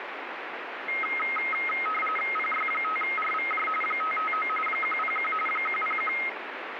RTTY (45.45 baud, 850 Hz shift), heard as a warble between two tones, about 1700 Hz centre, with radio static. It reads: PY5RVJ 559 101 101